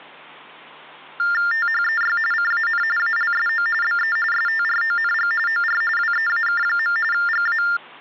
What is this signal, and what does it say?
TTY/TDD text telephone tones (45.45 baud Baudot), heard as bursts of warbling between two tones, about 400 Hz shift, 1600 Hz centre, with hum. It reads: THEY CAN ALSO BE STRONG OR WEAK. GA